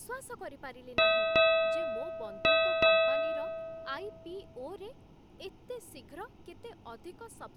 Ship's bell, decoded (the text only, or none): 4